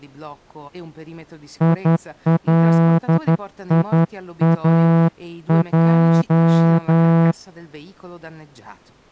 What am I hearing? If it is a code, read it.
Morse code, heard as a horn, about 11 wpm, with speech in Italian. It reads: ILIAJ